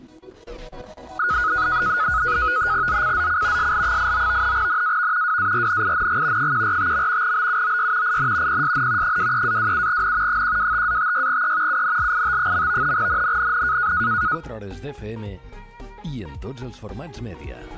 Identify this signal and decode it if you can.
NAVTEX (SITOR-B), 100 baud, 170 Hz shift, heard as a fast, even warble, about 1360 Hz centre. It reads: ZCZC SL89 NAV WARNING 145. BUOY IN PSN 23-27N 125-56E UNLIT. NNNN